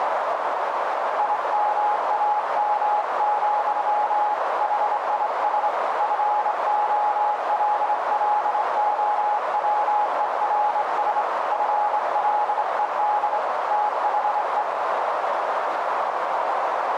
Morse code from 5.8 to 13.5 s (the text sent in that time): FOLLOWERS FLED